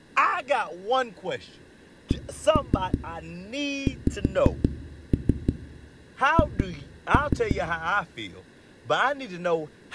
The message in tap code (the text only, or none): CXH